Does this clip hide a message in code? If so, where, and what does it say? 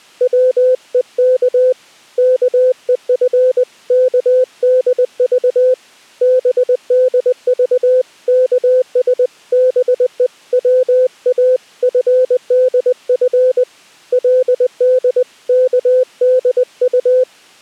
Yes: Morse code (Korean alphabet) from 0.2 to 17.3 s, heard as a keyed tone, hand-sent with a paddle, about 20 wpm, 510 Hz. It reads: 방 안을 들여다보는 그의